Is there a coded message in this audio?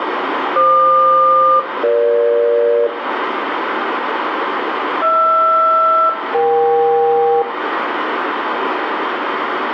Yes: aircraft SELCAL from 0.6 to 7.4 s, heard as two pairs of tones, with radio static and room echo. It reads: FQ-EG HR-EK